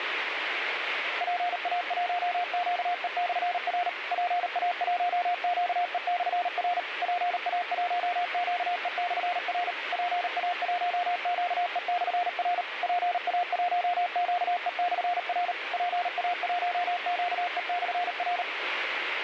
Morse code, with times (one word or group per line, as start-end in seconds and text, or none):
1.2-3.9 PA1QE/R
4.1-6.8 PA1QE/R
7.0-9.7 PA1QE/R
9.9-12.6 PA1QE/R
12.8-15.5 PA1QE/R
15.7-18.4 PA1QE/R